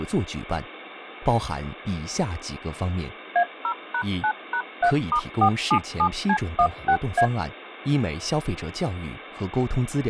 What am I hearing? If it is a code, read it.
DTMF, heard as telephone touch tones, dialled by machine, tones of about 80 ms. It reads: A0#9#3*477C16A